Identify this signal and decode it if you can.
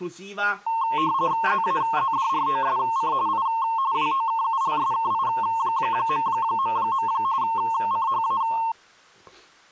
RTTY (45.45 baud, 170 Hz shift), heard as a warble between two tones, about 990 Hz centre, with speech in Italian. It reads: ZAZDROSC I WOKULSKI... CHA